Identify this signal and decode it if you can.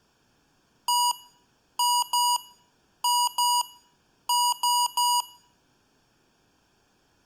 Beep code, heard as beeps from a small speaker, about 970 Hz. 1-2-2-3. In Phoenix BIOS tables: BIOS ROM checksum failure.